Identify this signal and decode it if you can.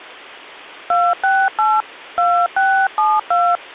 DTMF, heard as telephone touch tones, dialled by hand, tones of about 270 ms. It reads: 268 2672